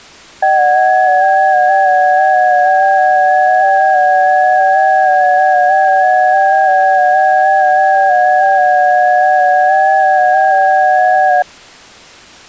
FT8 (several signals at once), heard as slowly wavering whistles, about 6.25 baud.